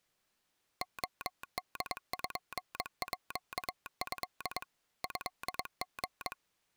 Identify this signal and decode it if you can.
Morse code (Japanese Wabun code), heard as a telegraph sounder, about 22 wpm. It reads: レポート トリ